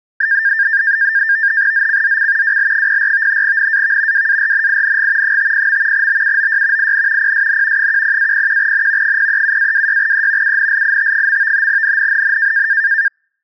NAVTEX (SITOR-B), 100 baud, 170 Hz shift, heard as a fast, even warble, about 1700 Hz centre. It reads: ZCZC WL04 NAV WARNING 50. BUOY IN PSN 10-01N 037-26E UNLIT. NNNN